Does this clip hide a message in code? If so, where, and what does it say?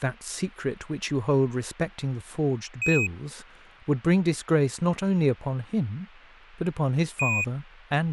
Yes: Quindar tones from 2.8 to 7.4 s, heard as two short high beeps, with speech in English.